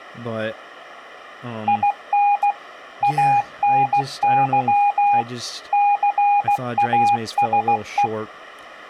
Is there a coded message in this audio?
Yes: Morse code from 1.6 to 8.1 s, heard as a keyed tone, machine-sent, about 16 wpm, 820 Hz, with speech in English. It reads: IN ANY CASE